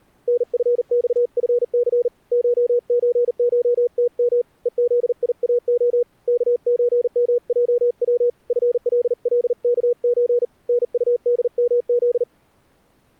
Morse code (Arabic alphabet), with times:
0.3-2.1 نفصفث
2.3-4.4 شزشتم
4.7-6.0 ءذياخ
6.3-8.3 كزمجو
8.5-10.4 فللكز
10.7-12.2 نطدمذ

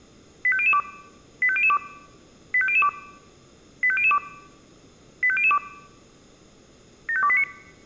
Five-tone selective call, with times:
0.4-0.8 85002
1.4-1.8 85002
2.5-2.9 85002
3.8-4.2 85002
5.2-5.6 85002
7.1-7.4 75289

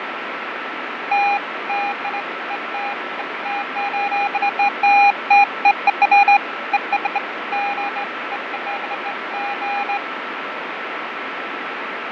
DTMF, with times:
none

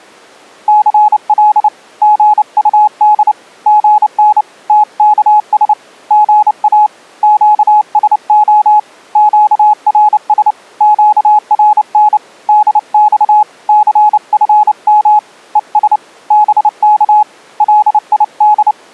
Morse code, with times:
0.7-1.7 CL
2.0-3.3 GUD
3.7-4.4 GN
4.7-5.7 TKS
6.1-6.9 GA
7.2-8.8 QSO
9.2-10.5 QRS
10.8-12.2 QRN
12.5-13.4 DX
13.7-15.2 CFM
15.6-16.0 ES
16.3-17.2 BK
17.6-18.7 LID

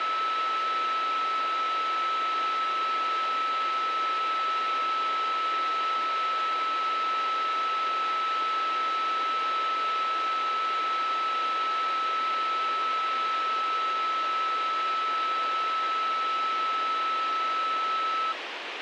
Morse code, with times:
none

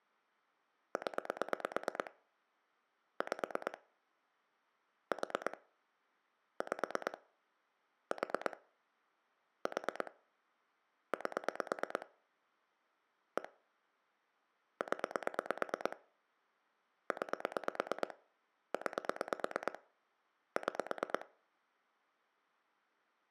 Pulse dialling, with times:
1.0-2.1 0
3.2-3.8 5
5.1-5.6 4
6.6-7.2 5
8.1-8.6 4
9.7-10.1 4
11.1-12.1 8
13.4-13.5 1
14.8-16.0 0
17.1-18.1 9
18.7-19.8 9
20.6-21.3 6

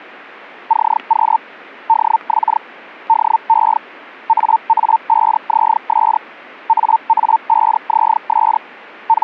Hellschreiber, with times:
0.7-1.4 CQ
1.9-2.6 DX
3.1-3.8 DE
4.3-6.2 AA5ZS
6.7-8.6 AA5ZS
9.1-9.2 …

